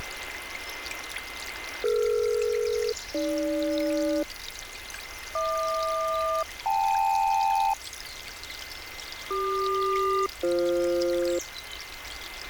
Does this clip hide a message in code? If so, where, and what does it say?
Yes: aircraft SELCAL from 1.8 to 11.4 s, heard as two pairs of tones, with radio static and a steady whistle near 2070 Hz. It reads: DE-AG HQ-KL CQ-BF